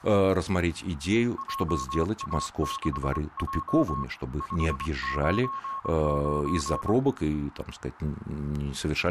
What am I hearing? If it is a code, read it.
Morse code, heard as a keyed tone, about 24 wpm, 1090 Hz, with radio static and speech in Russian. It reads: JA6J 599